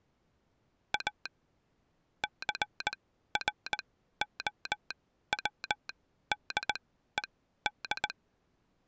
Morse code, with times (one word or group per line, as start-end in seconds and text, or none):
0.9-1.3 A
2.2-8.1 CROWDED